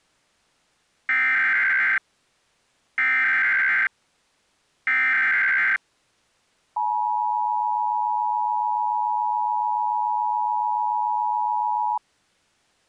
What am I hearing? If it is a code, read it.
Emergency Alert System (SAME) tones (header bursts, then the 853 and 960 Hz attention tone), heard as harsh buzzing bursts, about 520.83 baud.